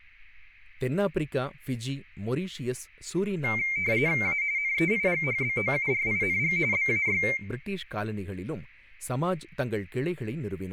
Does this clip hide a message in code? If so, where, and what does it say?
Yes: RTTY (45.45 baud, 170 Hz shift) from 3.4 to 7.4 s, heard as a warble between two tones, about 2200 Hz centre, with speech in Tamil. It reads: A NEIGHBOURING BAY